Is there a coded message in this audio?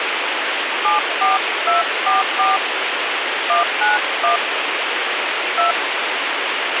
Yes: DTMF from 0.8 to 5.7 s, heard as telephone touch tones, dialled by hand, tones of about 150 ms, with radio hiss and a squelch burst at the end. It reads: 74244 191 2